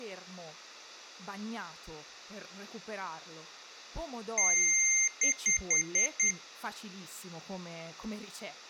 Beep code, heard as beeps from a small speaker, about 2100 Hz, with speech in Italian. 1 long, 5 short.